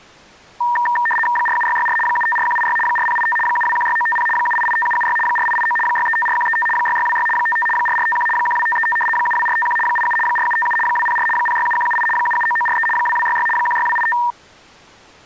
RTTY (75 baud, 850 Hz shift), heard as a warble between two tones, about 1390 Hz centre. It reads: 47664 754186 4085 7216950 7885776 4889 6354135 6626 55 4451 12535 72451 87 4757 204 067178 779943 2266 16285